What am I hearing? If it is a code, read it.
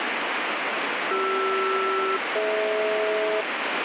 Aircraft SELCAL, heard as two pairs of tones, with heavy radio static. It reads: CR-DH